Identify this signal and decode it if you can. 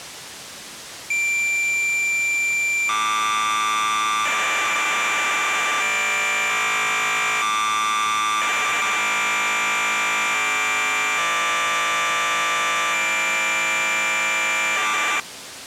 Cassette data (Kansas City type), 1200 baud, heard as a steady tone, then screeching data.